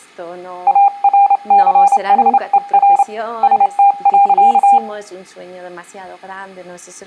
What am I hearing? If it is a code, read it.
Morse code, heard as a keyed tone, hand-sent with a straight key, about 28 wpm, 800 Hz. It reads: ARCHER ST.